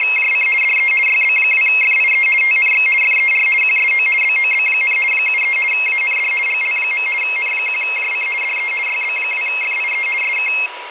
RTTY (50 baud, 450 Hz shift), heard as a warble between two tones, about 2350 Hz centre, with radio static and a steady whistle near 970 Hz. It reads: … DE YB2FIE TNX FER QSO BOB, 73 AND GL. N1JC DE YB2FIE SK